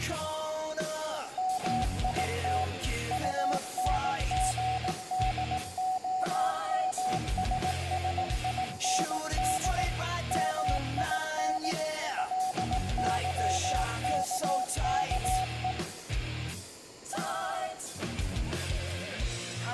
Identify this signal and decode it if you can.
Morse code, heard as a keyed tone, machine-sent, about 18 wpm, 750 Hz, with room echo. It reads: MIT UNGDOMSSIND MIN LYKKE